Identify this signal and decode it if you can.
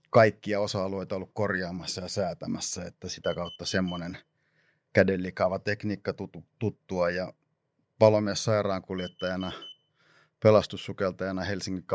Alarm pattern, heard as an alarm's beeps, played twice, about 3050 Hz, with room echo and speech in Finnish. Temporal four. Carbon monoxide.